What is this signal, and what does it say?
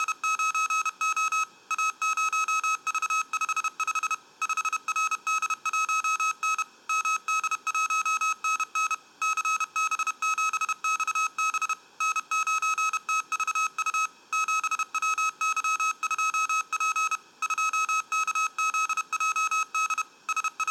Morse code, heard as electronic beeps, machine-sent, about 31 wpm, 1280 Hz. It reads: … A0V55 5RD1N MD1NN CB7XB N9TVU 7WY2P 2KZJD …